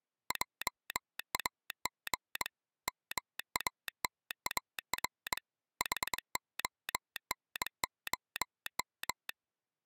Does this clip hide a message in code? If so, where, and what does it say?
Yes: Morse code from 0.2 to 9.4 s, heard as a telegraph sounder, hand-sent with a bug key, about 22 wpm. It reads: JAG MATAR HONOM